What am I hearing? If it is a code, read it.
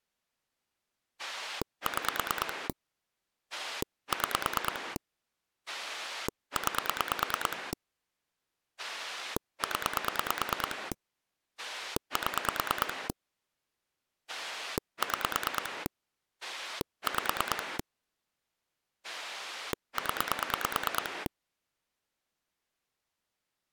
Pulse dialling, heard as a rotary dial, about 9 pulses a second. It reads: 6 6 9 0 7 6 5 0